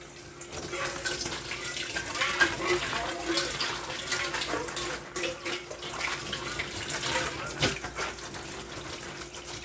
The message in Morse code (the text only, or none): none